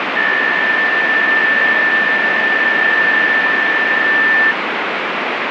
PSK63 (62.5 baud), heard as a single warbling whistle, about 1800 Hz, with radio static.